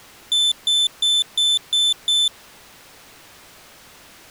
Beep code, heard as a piezo beeper, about 3550 Hz. 6 short. In AMI BIOS tables: keyboard controller gate A20 failure; in Dell tables: video card failure.